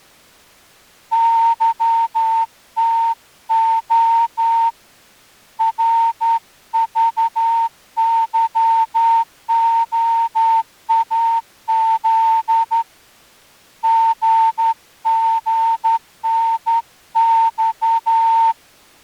Morse code, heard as a whistle, hand-sent with a straight key, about 11 wpm. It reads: YTO RVYOAZ GGNX